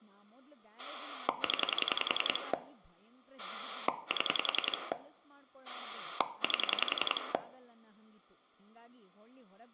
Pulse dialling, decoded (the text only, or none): 0 7 8